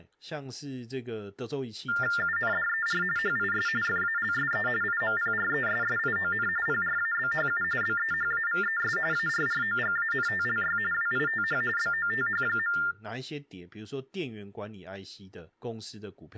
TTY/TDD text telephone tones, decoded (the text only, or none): UNDER HIS FALSE IMPRESSION PRABHU BEHAVES ARROGANTLY WITH BOTH.